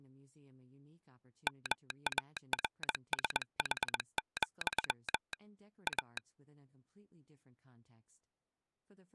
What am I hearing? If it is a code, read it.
Morse code, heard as a telegraph sounder, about 21 wpm, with speech in English. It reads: MARSH, A